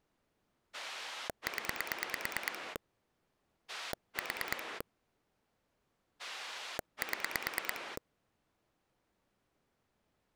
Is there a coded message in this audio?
Yes: pulse dialling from 0.7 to 8.0 s, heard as a rotary dial, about 9 pulses a second. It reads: 0 4 7